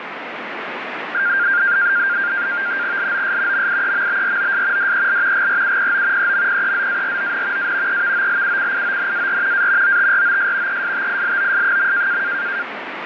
NAVTEX (SITOR-B), 100 baud, 170 Hz shift, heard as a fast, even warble, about 1500 Hz centre, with radio static. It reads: LOS MIEMBROS DEL GRUPO EMPEZARON A EVOLUCIONAR A OTROS ESTILOS.